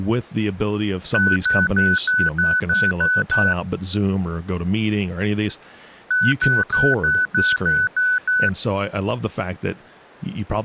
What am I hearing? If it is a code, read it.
Beep code, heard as beeps from a small speaker, played twice, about 1500 Hz, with speech in English. 8 short. In AMI BIOS tables: display memory failure; in Dell tables: LCD failure.